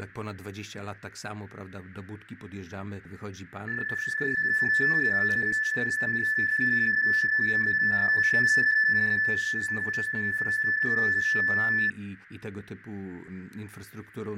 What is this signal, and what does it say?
PSK31 (31.25 baud), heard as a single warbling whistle, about 1750 Hz, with radio static and fading.